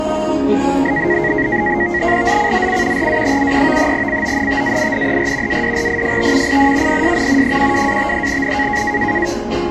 NAVTEX (SITOR-B), 100 baud, 170 Hz shift, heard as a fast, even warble, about 2000 Hz centre, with static crashes and the noise of a cafe. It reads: ZCZC RA73 CONTAINER ADRIFT IN PSN 12-53N